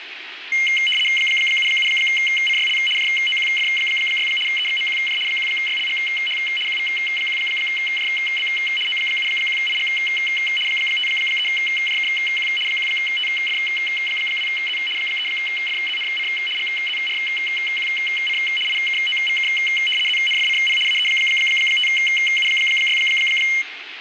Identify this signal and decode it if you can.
RTTY (75 baud, 850 Hz shift), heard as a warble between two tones, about 2550 Hz centre, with radio static. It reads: 77CYL JOQF6 EXMQJ 1YLGH QV1JB O71IG 53JKQ 1TF2Z 3FZNC GZRQC IKOVK ZNFCP AE5U6